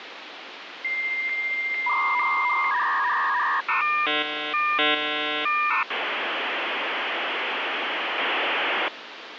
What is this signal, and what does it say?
Dial-up modem handshake (V.34 or later), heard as a whistle, warbles, then hiss, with phone line noise.